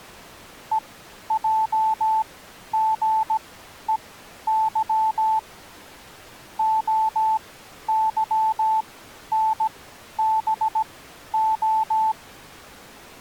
Morse code, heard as a keyed tone, machine-sent, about 17 wpm, spaced as for 11 wpm, 880 Hz. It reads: EJGEY OYNBO